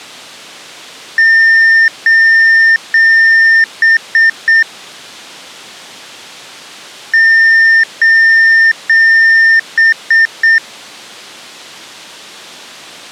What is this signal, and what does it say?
Beep code, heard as beeps, played twice, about 1800 Hz. 3 long, 3 short.